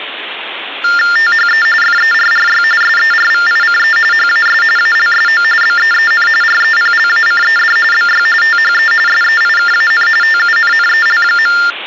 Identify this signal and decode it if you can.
TTY/TDD text telephone tones (45.45 baud Baudot), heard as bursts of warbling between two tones, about 400 Hz shift, 1600 Hz centre, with phone line noise. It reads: THE FERRY SERVICE HAS ALSO BEEN REPLACED BY THE SEIKAN TUNNEL.